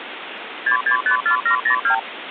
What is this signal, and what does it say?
Multi-frequency trunk signalling (R2, with the far end's replies), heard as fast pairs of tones, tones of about 100 ms, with phone line noise. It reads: 6654702